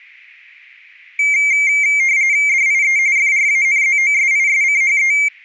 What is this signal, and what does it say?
RTTY (45.45 baud, 170 Hz shift), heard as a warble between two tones, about 2200 Hz centre. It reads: DIE FRANZOSISCHE